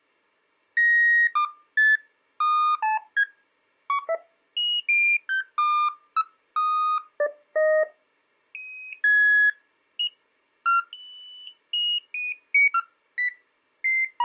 Electronic bleeps of random pitch and length. There is no code.